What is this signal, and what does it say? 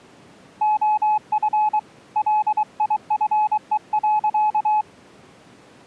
Morse code, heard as a keyed tone, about 23 wpm, 850 Hz. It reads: OF LIFE.